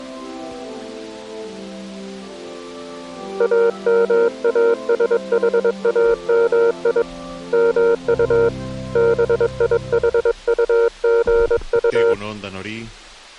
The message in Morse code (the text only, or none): AMASHAMI MU BIHUGU